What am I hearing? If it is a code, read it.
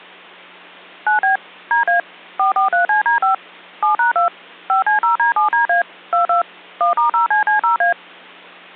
DTMF, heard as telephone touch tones, dialled by machine, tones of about 120 ms, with hum. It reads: 9B DA 443CD5 7#2 5C0D7DA 22 1*0CC0A